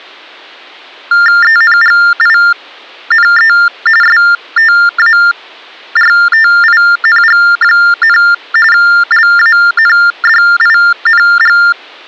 TTY/TDD text telephone tones (45.45 baud Baudot), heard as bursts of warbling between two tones, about 400 Hz shift, 1600 Hz centre. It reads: ENGINE STARTING, LANDING